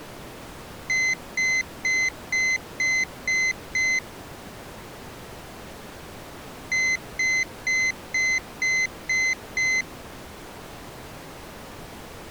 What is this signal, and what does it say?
Beep code, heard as a piezo beeper, played twice, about 2050 Hz. 7 short. In AMI BIOS tables: virtual mode exception error; in Dell tables: processor failure.